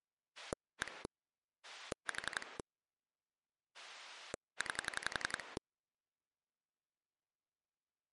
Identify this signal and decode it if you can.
Pulse dialling, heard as a rotary dial, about 11 pulses a second. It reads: 1 4 9